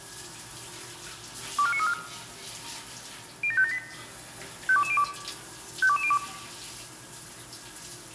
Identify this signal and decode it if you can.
Five-tone selective call (ZVEI), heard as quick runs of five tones, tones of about 70 ms, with the noise of a restroom. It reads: 24934 07578 52202 52202